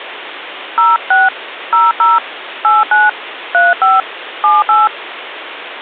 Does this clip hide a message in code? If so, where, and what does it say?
Yes: DTMF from 0.8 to 4.9 s, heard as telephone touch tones, dialled by hand, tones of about 180 ms, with phone line noise. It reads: 06 00 89 35 78